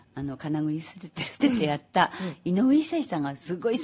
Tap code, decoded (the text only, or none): none